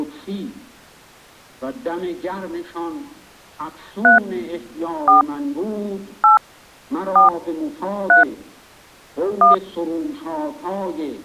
DTMF, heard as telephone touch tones, dialled by hand, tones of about 130 ms. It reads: 3 4 8 4 3 1